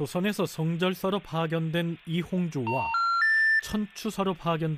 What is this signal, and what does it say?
Telephone call progress tone (North American plan), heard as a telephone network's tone, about 910, 1370, 1800 Hz, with room echo and speech in Korean. Special information tone.